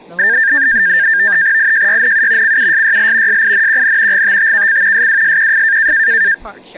NAVTEX (SITOR-B), 100 baud, 170 Hz shift, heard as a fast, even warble, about 1700 Hz centre, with speech in English. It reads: IJYNU CUSYL SINQN GTTKC SWSQF